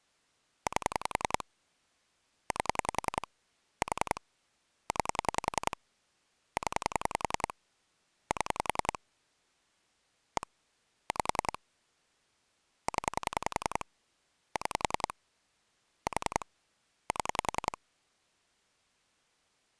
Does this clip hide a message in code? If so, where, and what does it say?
Yes: pulse dialling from 0.7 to 17.8 s, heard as clicks on a phone line, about 10 pulses a second. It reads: 8 8 4 9 0 7 1 5 0 6 4 7